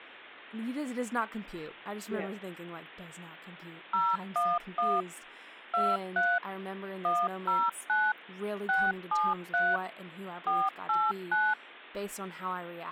DTMF, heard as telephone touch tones, dialled by machine, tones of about 220 ms, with speech in English. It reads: 011 23 109 673 489